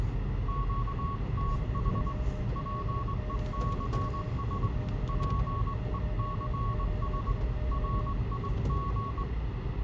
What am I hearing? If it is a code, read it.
Morse code, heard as two keyed tones, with radio static, room echo and the noise inside a car. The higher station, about 21 wpm, 1110 Hz: QTH PECS PECS RIG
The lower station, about 25 wpm, 610 Hz: SOL7M XI1O2